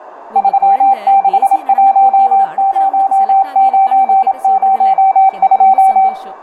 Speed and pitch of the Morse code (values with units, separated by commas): 27 wpm, 780 Hz